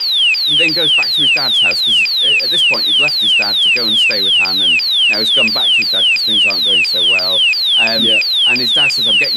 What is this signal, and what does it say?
A tone that sweeps in pitch again and again, with radio static and speech in English. There is no code.